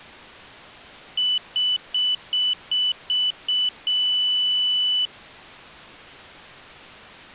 Beep code, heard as a piezo beeper, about 3000 Hz. 7 short, 1 long.